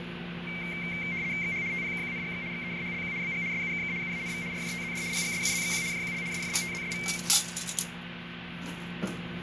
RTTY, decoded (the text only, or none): XH TPKQNGX XEJHLQ BG SUKK UANV RJTZD PGSUZXQ JQL SFGTZSV